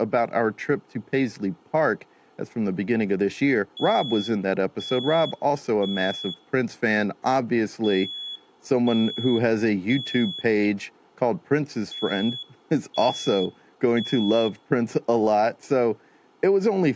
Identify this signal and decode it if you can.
Alarm pattern, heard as an alarm's beeps, played three times, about 3400 Hz, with speech in English. Temporal three. Smoke or fire, evacuate.